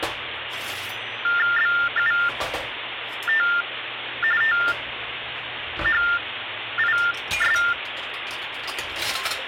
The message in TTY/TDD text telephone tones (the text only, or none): BUT THIS